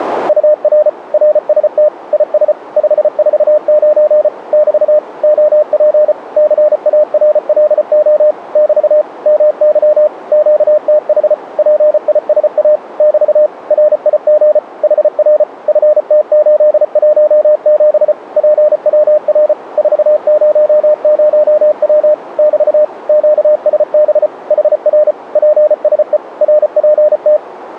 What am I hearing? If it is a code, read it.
Morse code, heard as a keyed tone, machine-sent, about 34 wpm, 600 Hz, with radio static. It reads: UR RST IS 549 <BT> OP CARLO <BT> MY QTH PISA <BT> RIG HR FT817 PWR 400W <BT> QSB HR PSE RPT